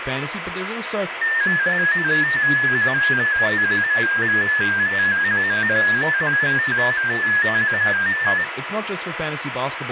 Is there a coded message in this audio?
Yes: multi-tone FSK (Olivia or MFSK type), about 250 Hz wide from 1.2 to 8.4 s, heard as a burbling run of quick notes, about 15.625 baud, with radio static and speech in English.